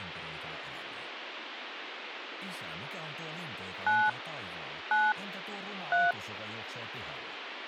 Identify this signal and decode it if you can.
DTMF, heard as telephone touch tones, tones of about 240 ms, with radio hiss. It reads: 9 9 3